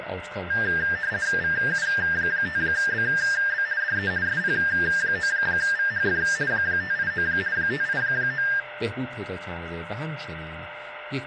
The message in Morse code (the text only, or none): none